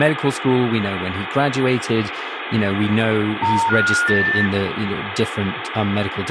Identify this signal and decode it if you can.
Telephone call progress tone (North American plan), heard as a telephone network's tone, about 910, 1430, 1800 Hz, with phone line noise and speech in English. Special information tone.